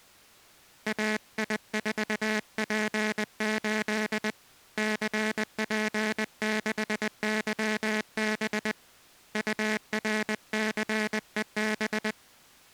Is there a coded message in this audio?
Yes: Morse code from 0.8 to 12.2 s, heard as a buzzer, hand-sent with a paddle, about 20 wpm. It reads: AI4P8 CP6YB URCEB